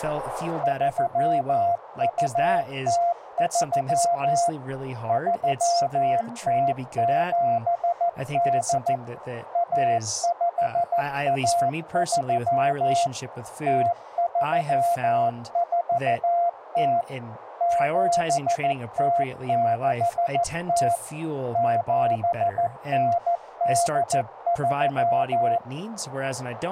Morse code (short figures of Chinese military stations), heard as a keyed tone, machine-sent, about 14 wpm, 690 Hz, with radio static and speech in English. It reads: 3203 3078 1513 0340 7060 7983